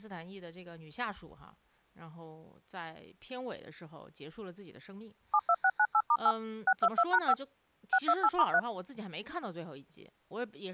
DTMF, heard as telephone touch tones, dialled by machine, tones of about 60 ms, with speech in Chinese. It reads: 72698*8 622#5 628*3